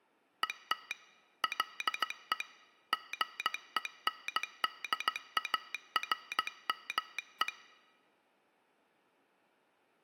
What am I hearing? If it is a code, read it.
Morse code, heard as a telegraph sounder, hand-sent with a straight key, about 16 wpm. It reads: ET LE GENDARME